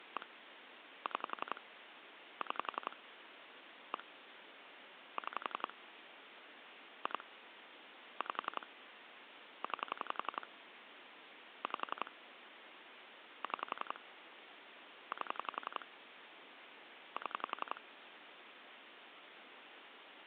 Pulse dialling, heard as clicks on a phone line, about 11 pulses a second, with phone line noise. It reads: 1 6 6 1 6 2 5 9 5 6 8 7